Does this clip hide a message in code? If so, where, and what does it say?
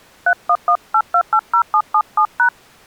Yes: DTMF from 0.3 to 2.5 s, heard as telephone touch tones, dialled by hand, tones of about 80 ms. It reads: 3118280777#